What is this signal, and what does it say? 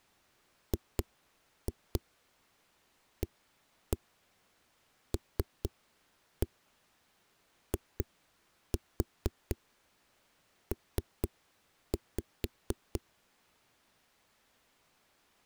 Tap code, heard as knocks on a wall, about 4 knocks a second. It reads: GALIP